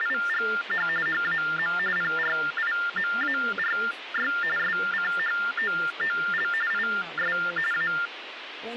TTY/TDD text telephone tones (45.45 baud Baudot), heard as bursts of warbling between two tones, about 400 Hz shift, 1600 Hz centre, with phone line noise and speech in English. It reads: … HAM PRIMARY SCHOOL IS A